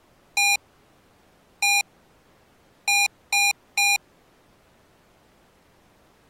Beep code, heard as beeps from a small speaker, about 810 Hz. 1-1-3. In Phoenix BIOS tables: CMOS read or write failure.